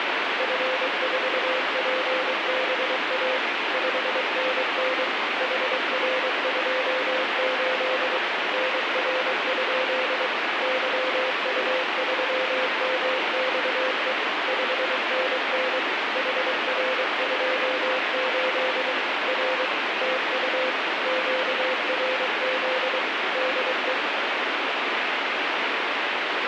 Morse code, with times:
0.4-3.4 F4PBA
3.7-5.0 5NN
5.4-8.2 HR28
8.5-10.3 NR?
10.6-14.1 YU3MXE
14.5-15.8 5NN
16.2-18.9 HR28
19.3-19.7 R
20.0-20.7 TU
21.1-23.0 QRZ
23.4-23.9 DE

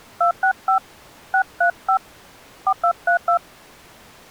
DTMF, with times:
0.2-0.8 265
1.3-2.0 635
2.7-3.4 4232

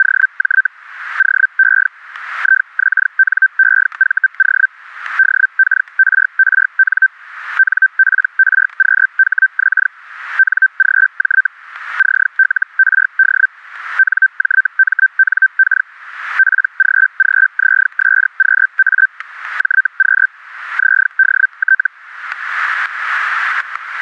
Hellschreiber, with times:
0.0-0.7 …
1.2-1.9 OE
2.4-4.7 IXNEVO
5.2-7.1 DKRRN
7.6-9.9 NPRQHX
10.4-11.5 NGJ
12.0-13.5 CLRD
14.0-15.9 NJMNK
16.4-19.1 PGGZSQA
19.6-20.3 JQ
20.8-21.9 ZDT

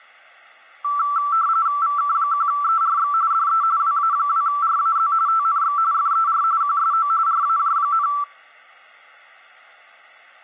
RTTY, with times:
1.8-3.1 VK1ERX
3.3-3.6 DE
3.8-5.1 WA2RAZ
5.3-5.8 TNX
5.9-6.4 FER
6.6-7.1 QSO
7.3-8.1 RAJ,

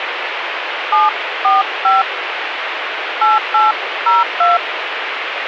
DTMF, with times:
0.9-2.0 745
3.2-4.6 8802

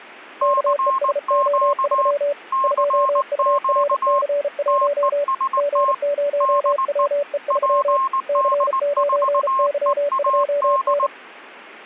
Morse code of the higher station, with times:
0.4-2.1 CQ
2.5-4.2 CQ
4.7-5.9 TEST
6.4-7.1 DE
7.5-11.1 PD4EAD

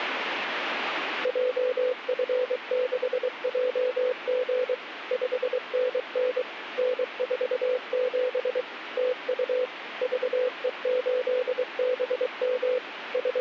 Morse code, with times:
1.3-4.7 JF6JG
5.1-6.4 5NN
6.8-8.6 N47
9.0-9.7 TU
10.0-12.8 VE8BM
13.1-13.4 …

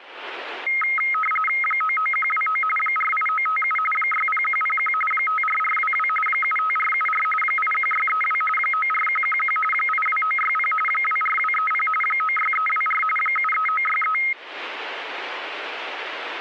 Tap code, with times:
none

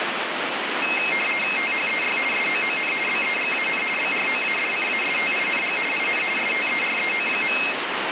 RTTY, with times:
1.6-2.2 THEY
2.3-2.9 SOON
3.1-3.8 BEGAN
4.0-5.8 BROADCASTING
5.9-6.2 IN
6.4-7.6 STEREO.

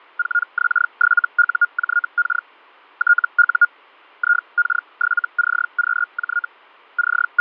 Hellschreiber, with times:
0.2-2.5 4X7UJK
3.0-3.7 TU
4.2-6.5 IK7CQJ
7.0-7.4 …

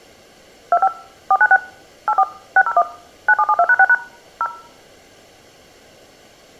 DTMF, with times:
0.7-0.9 25
1.3-1.6 496
2.1-2.2 84
2.6-2.8 601
3.3-3.9 9772#6#
4.4-4.5 0

